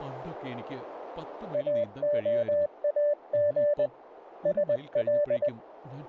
Morse code (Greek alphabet), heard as a keyed tone, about 20 wpm, 590 Hz, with radio static, a narrow filter and speech in Malayalam. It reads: ΑΟΑΓ ΣΛ